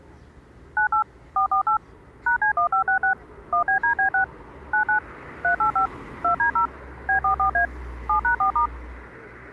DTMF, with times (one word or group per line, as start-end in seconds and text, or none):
0.8-1.0 98
1.4-1.8 448
2.3-3.1 #C1566
3.5-4.2 1BDB6
4.7-5.0 99
5.4-5.9 385
6.2-6.7 2D0
7.1-7.7 B44A
8.1-8.7 7#4*